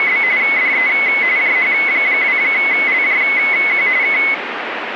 RTTY (45.45 baud, 170 Hz shift), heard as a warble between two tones, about 2100 Hz centre, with radio static. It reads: … DE JH2LJQ K